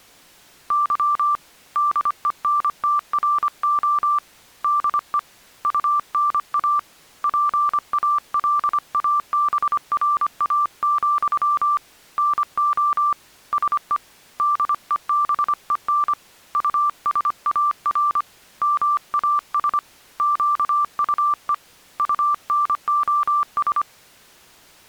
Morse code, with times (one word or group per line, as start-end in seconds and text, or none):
0.7-1.4 Y
1.8-4.2 DENTRO
4.6-5.2 DE
5.6-6.8 UNA
7.2-11.8 PALABRA,
12.2-13.1 NO
13.5-14.0 SE
14.4-16.1 DEBEN
16.5-18.2 USAR
18.6-19.8 MAS
20.2-21.5 QUE
22.0-23.8 UNOS